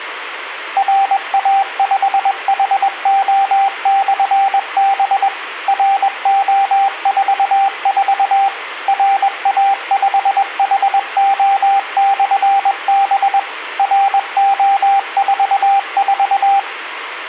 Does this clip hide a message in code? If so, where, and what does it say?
Yes: Morse code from 0.7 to 16.7 s, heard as a keyed tone, machine-sent, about 21 wpm, 790 Hz. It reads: RA5HO/B RO44 RA5HO/B RO44